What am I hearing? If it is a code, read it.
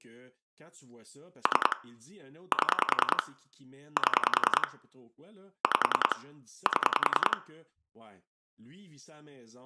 Pulse dialling, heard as clicks on a phone line, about 10 pulses a second, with room echo and speech in French. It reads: 3 7 7 5 7